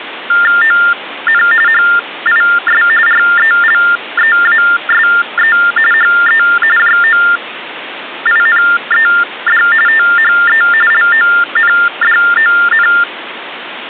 TTY/TDD text telephone tones (45.45 baud Baudot), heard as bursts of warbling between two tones, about 400 Hz shift, 1600 Hz centre, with phone line noise. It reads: ON HIS RELEASE HE JOINED THE LONDON